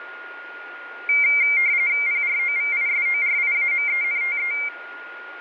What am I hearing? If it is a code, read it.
RTTY (45.45 baud, 170 Hz shift), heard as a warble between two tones, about 2200 Hz centre, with radio static and a steady whistle near 1430 Hz. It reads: PROVISORIAMENTE